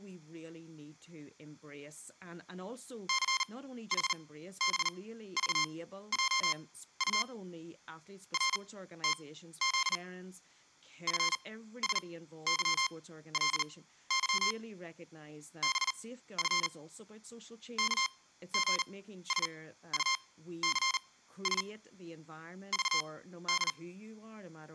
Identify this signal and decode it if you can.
Morse code, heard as electronic beeps, machine-sent, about 39 wpm, spaced as for 15 wpm, 1060 Hz, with room echo and speech in English. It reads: CHBVJU RTZ FSYLY BF KGSUCS VD